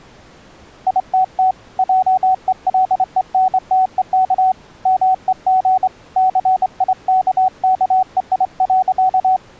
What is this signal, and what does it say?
Morse code, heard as a keyed tone, hand-sent with a straight key, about 25 wpm, 750 Hz. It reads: ITT JELENTEK MEG CIKKEI.